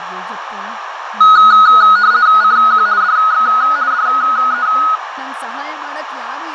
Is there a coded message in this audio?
Yes: RTTY (50 baud, 170 Hz shift) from 1.2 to 5.0 s, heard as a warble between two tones, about 1360 Hz centre, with radio static, fading, a narrow filter and speech in Kannada. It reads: CQ DX DE